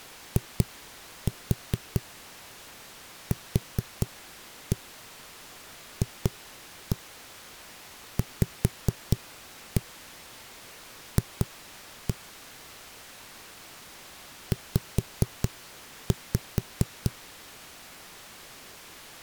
Tap code, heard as knocks on a wall, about 4 knocks a second. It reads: IQFVF Z